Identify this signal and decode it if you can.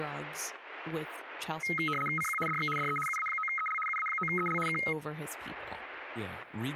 RTTY (75 baud, 850 Hz shift), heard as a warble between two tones, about 1700 Hz centre, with static crashes and speech in English. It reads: CQ DX DE UA9EL UA9EL K